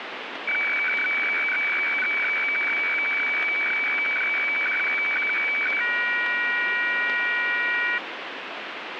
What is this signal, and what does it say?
Weather fax (radiofax), 120 lines a minute, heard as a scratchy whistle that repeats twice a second, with radio static.